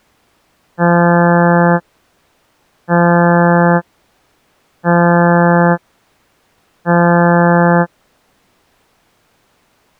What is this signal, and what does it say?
Ship horn signal, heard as a ship's horn, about 170 Hz. 4 short. At sea: a pilot vessel's identity signal in fog.